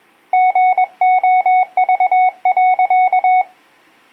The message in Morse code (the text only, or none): GOV.